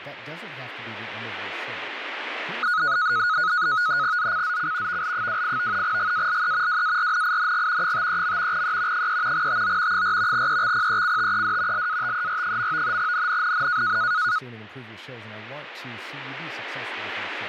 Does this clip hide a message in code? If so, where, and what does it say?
Yes: NAVTEX (SITOR-B), 100 baud, 170 Hz shift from 2.6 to 14.4 s, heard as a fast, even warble, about 1360 Hz centre, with radio static and speech in English. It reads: ZCZC VL28 GALE WARNING 53. E 3 TO 4 EXPECTED LATER. NNNN